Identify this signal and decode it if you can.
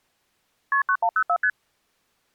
Multi-frequency trunk signalling (R1, as on North American trunks), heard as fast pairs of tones, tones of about 70 ms. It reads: KP 9104 ST